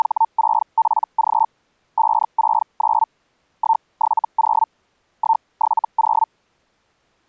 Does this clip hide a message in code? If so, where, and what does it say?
Yes: Hellschreiber (Feld-Hell, 122.5 baud) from 0.0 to 6.3 s, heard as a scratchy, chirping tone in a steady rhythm, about 900 Hz. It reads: … 569 170 170